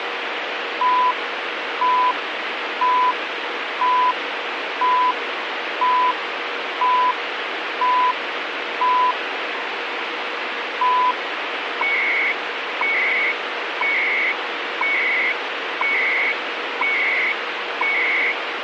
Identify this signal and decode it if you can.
Radio time signal (CHU, Canada), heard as beeps and data bursts, one a second, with radio static.